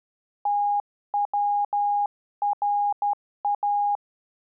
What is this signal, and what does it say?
Morse code (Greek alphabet), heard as a keyed tone, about 12 wpm, 820 Hz. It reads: ΤΩΡΑ